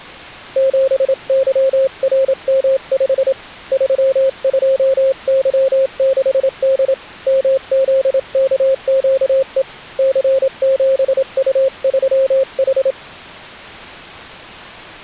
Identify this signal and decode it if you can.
Morse code, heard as a keyed tone, hand-sent with a straight key, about 27 wpm, 530 Hz. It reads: 7YRM5 32Y6D MZKQE C7U3H